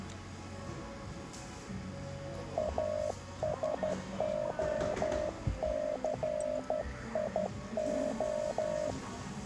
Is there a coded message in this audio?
Yes: Morse code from 2.5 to 9.0 s, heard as a keyed tone, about 12 wpm, 610 Hz, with the noise of a cafe. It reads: ASOCIO